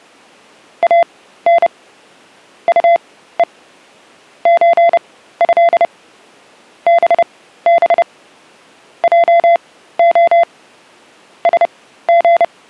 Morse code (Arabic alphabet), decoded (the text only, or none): ان طء زه بب جخ سغ